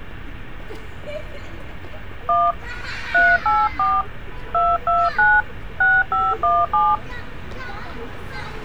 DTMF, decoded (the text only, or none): 1 384 229 6517